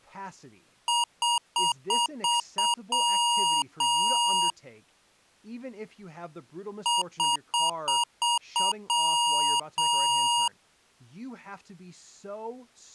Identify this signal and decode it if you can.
Beep code, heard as beeps from a small speaker, played twice, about 950 Hz, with speech in English. 6 short, 2 long.